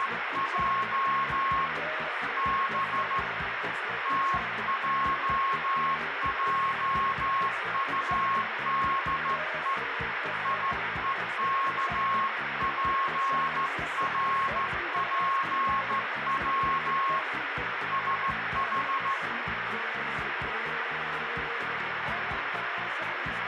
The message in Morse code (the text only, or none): … B TJJUDE IEKPRPW SH